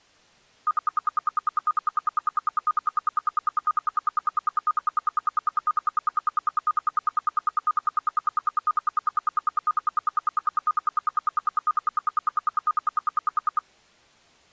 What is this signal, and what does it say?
Radio time signal (RWM, Moscow), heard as ten pulses a second.